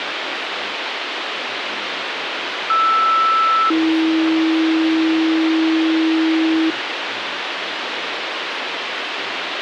Two-tone page, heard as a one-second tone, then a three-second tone, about 1320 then 320 Hz, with radio hiss and speech in English.